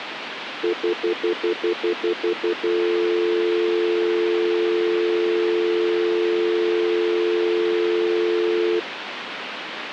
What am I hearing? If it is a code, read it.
Telephone call progress tone (North American plan), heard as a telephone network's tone, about 350, 440 Hz, 0.1 s on and 0.1 s off, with phone line noise. Stutter dial tone.